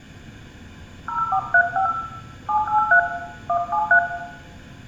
DTMF, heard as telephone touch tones, dialled by hand, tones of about 100 ms, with room echo. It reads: 0435 783 173